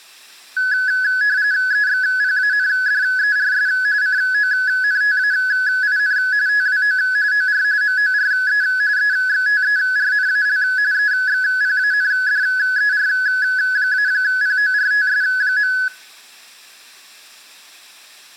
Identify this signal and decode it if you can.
RTTY (45.45 baud, 170 Hz shift), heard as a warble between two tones, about 1600 Hz centre, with room echo. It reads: EXPANDERS CONTAIN TWO OR MORE EXTERNAL EXPANDER-PORTS.